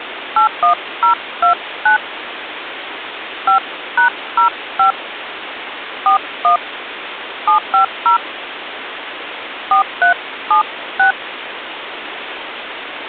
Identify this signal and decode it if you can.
DTMF, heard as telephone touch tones, dialled by hand, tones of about 110 ms, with phone line noise. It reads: 81029 5#05 41 750 4376